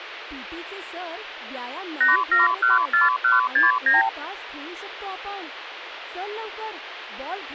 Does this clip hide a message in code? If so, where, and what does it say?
Yes: multi-frequency trunk signalling (R2, with the far end's replies) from 2.0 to 4.1 s, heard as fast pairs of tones, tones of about 160 ms, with phone line noise and speech in Marathi. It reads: 8714169